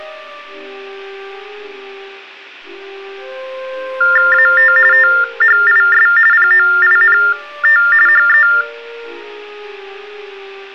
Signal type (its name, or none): TTY/TDD text telephone tones